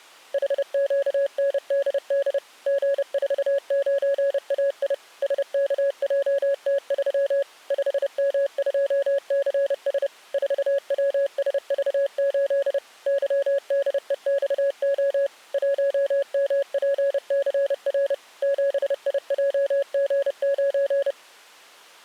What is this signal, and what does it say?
Morse code, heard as a keyed tone, machine-sent, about 30 wpm, 560 Hz. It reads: HQNDD G49AI SKJT3 5M2CS 4WSV8 YDEXO 1MPCR 7IJG9